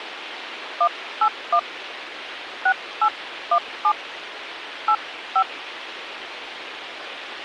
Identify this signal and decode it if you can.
DTMF, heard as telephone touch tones, dialled by hand, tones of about 70 ms, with radio hiss and a squelch burst at the end. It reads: 181 6817 85